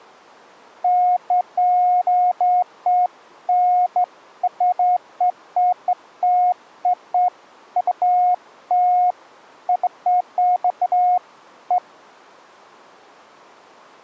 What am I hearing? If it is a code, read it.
Beeps of irregular length. There is no code.